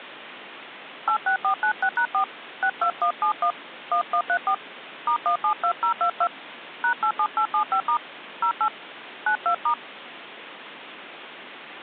DTMF, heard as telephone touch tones, dialled by hand, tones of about 80 ms, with phone line noise. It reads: 86496#4 62171 1134 *172022 #87875* 08 92*